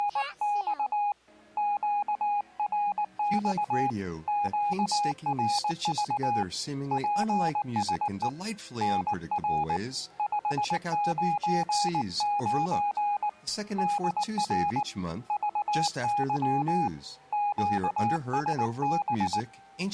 Morse code, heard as a keyed tone, hand-sent with a paddle, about 19 wpm, 820 Hz. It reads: … QRX QRV PSE NR 599 DR VY QSB